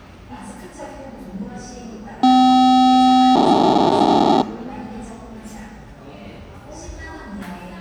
POCSAG pager data (512 baud), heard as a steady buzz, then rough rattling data, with the noise of a cafe.